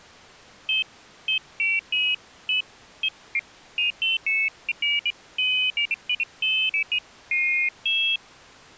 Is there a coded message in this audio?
No, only pairs of high tones at irregular times.